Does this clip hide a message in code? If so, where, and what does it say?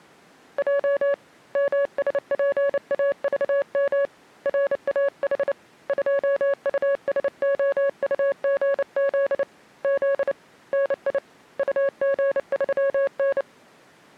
Yes: Morse code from 0.5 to 13.5 s, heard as a keyed tone, hand-sent with a paddle, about 29 wpm, 560 Hz. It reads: J MSPAVM RAH 2USOUGZ Z NI UG3N